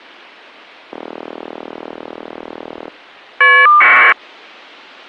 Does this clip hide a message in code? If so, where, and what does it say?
Yes: caller ID data burst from 0.9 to 4.1 s, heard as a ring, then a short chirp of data, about 1200 baud.